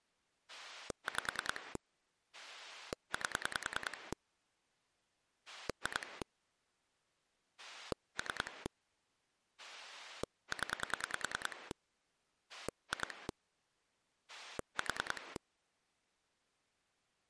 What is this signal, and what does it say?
Pulse dialling, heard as a rotary dial, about 10 pulses a second. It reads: 5 8 2 3 0 2 4